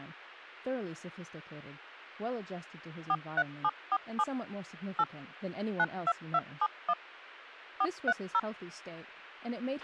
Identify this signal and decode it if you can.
DTMF, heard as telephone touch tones, dialled by machine, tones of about 50 ms, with a squelch burst at the end. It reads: 43747 8 92271 430